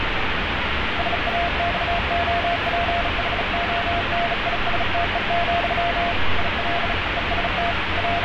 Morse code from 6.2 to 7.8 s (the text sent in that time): IL EST